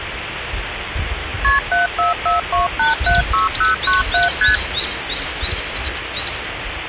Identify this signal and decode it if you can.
Multi-frequency trunk signalling (R1, as on North American trunks), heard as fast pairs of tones, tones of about 140 ms, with phone line noise and the noise of a park. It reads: KP 7442876097 ST